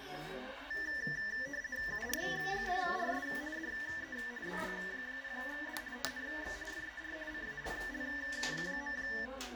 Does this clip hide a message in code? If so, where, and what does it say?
Yes: RTTY (50 baud, 170 Hz shift) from 0.7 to 9.3 s, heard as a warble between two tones, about 1850 Hz centre, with radio static and the noise of a crowd indoors. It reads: UR6RS DE BG0D TNX FER CALL.